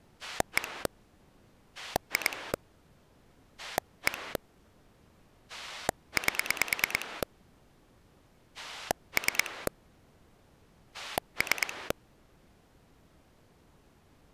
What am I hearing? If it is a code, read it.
Pulse dialling, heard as a rotary dial, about 9 pulses a second. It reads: 1 2 1 8 3 3